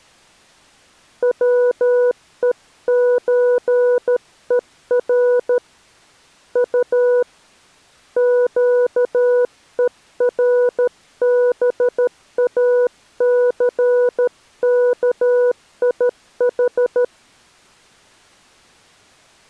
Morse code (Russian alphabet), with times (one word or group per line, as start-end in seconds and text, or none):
1.2-5.6 ВЕЧЕР
6.6-7.2 У
8.2-17.0 ЩЕРБАЦКИХ